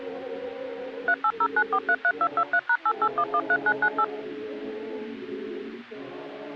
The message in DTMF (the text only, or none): 3809433223#88113998